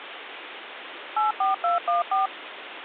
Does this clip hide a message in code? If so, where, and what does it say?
Yes: DTMF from 1.2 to 2.3 s, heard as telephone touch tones, dialled by machine, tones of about 140 ms, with phone line noise. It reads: 84214